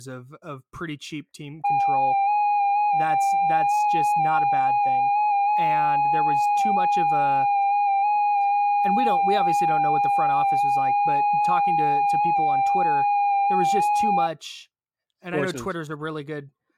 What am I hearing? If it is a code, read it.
FT8 (one signal), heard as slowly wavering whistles, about 6.25 baud, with speech in English.